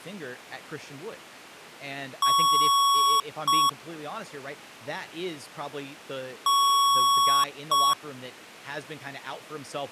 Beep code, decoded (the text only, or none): 1 long, 1 short